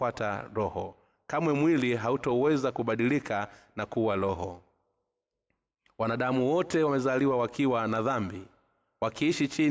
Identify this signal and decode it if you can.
Speech in Swahili. There is no code.